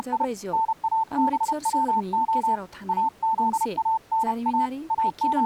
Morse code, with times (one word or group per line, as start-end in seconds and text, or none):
0.0-0.2 …
0.5-2.6 NABWO
2.9-4.7 AZANA
4.9-5.5 …